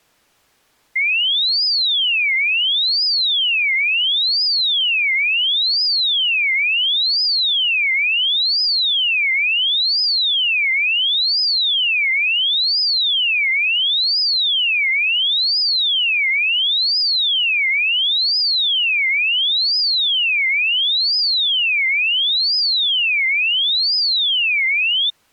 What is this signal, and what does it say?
A tone that sweeps in pitch again and again. There is no code.